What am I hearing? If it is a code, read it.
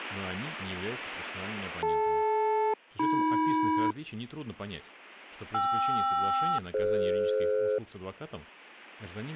Aircraft SELCAL, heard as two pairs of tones, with speech in Russian. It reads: DL-AM KR-DF